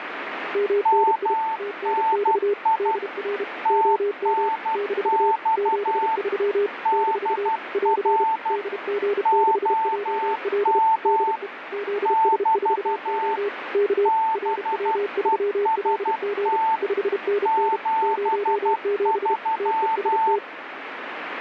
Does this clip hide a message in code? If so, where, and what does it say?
Yes: Morse code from 0.5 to 20.4 s, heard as two keyed tones, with radio static. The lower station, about 32 wpm, 410 Hz: MNI TNX DR OM - 73 - <AR> DG6JL DE ZS4O K RW3LG 5NN 07 TEST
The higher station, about 12 wpm, 890 Hz: MNI TNX DR OM <BT> BEST 73